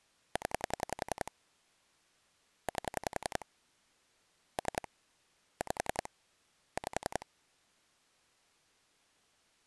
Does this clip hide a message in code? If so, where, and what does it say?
Yes: pulse dialling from 0.4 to 7.2 s, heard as clicks on a phone line, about 10 pulses a second. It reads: 0 8 3 5 5